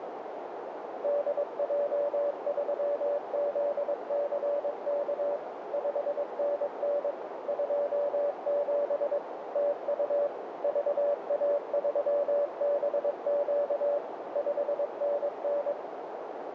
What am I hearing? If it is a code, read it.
Morse code, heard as a keyed tone, machine-sent, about 22 wpm, 580 Hz, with radio static and a narrow filter. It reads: DJ3ZCK 5NN 27 TU VA3BQ 5NN